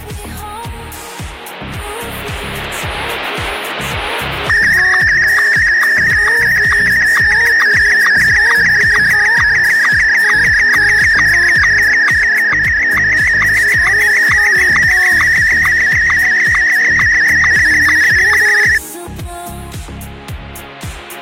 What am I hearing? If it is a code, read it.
SSTV (slow-scan television), Martin M1, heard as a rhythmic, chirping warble.